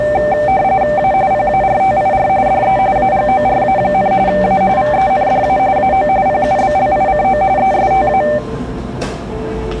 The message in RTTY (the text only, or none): A PARTIR DE AGORA, A VENDA AO PUBLICO ESTA